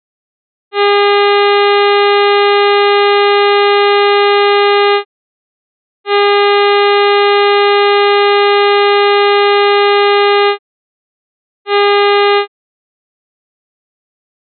Ship horn signal, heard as a ship's horn, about 410 Hz. 2 long, 1 short. At sea: I intend to overtake on your starboard side.